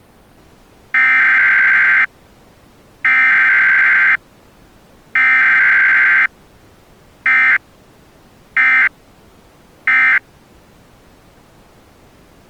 Emergency Alert System (SAME) tones (header bursts, then end-of-message bursts), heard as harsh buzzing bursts, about 520.83 baud.